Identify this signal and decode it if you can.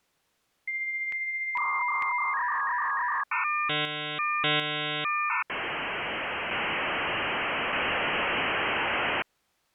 Dial-up modem handshake (V.34 or later), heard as a whistle, warbles, then hiss.